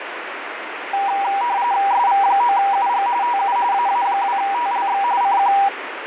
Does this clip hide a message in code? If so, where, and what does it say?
Yes: RTTY (45.45 baud, 170 Hz shift) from 0.9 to 5.7 s, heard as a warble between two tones, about 880 Hz centre, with radio static. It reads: SV9UG TU AA2TLX CQ